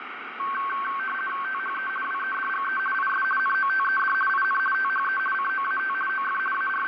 RTTY (50 baud, 450 Hz shift), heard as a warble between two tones, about 1330 Hz centre, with radio static. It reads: THE WEDGE IS NOTED IN THE COAT OF …